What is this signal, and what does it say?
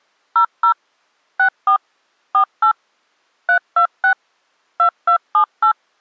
DTMF, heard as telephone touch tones, dialled by machine, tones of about 90 ms. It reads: 00 64 48 326 2278